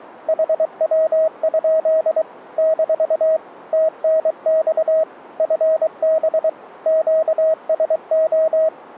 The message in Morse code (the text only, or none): HW? - TNX FB QSO